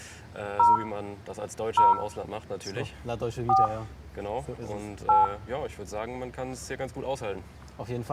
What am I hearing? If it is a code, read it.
DTMF, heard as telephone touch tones, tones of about 160 ms, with room echo. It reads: 0 0 4 8